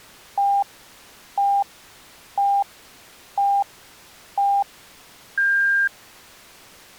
Radio time signal (five pips and a higher one, as on Chinese radio), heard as pips.